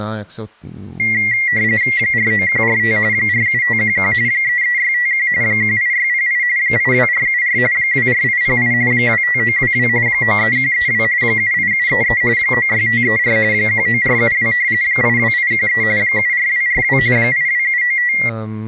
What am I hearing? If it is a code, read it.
RTTY (45.45 baud, 170 Hz shift), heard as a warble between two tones, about 2050 Hz centre, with speech in Czech. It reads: 49145 47511 33651 18608 82474 24808 25922 93132 78733 96534 19472 82813 74242 82795